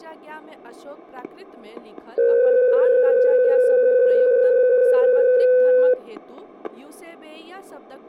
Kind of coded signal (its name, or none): PSK63